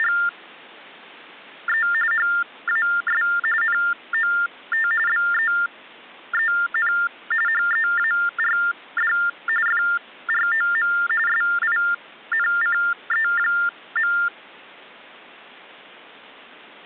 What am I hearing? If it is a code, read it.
TTY/TDD text telephone tones (45.45 baud Baudot), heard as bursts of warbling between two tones, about 400 Hz shift, 1600 Hz centre. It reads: … HAS NOT BEEN HEARD FROM SINCE.